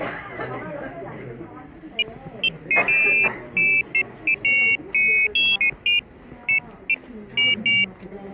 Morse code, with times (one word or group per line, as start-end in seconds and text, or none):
none